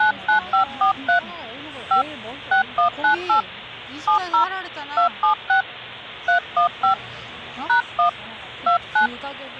DTMF, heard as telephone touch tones, dialled by hand, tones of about 110 ms, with the noise of a crowd indoors. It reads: 99543 5 6198 70 276 315 #1 29